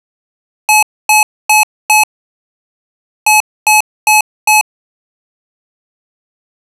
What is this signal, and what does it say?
Beep code, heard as beeps from a small speaker, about 860 Hz. 4-4.